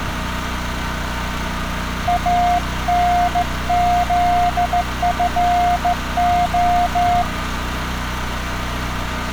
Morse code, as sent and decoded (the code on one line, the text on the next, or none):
.- -. --.. ..-. ---
ANZFO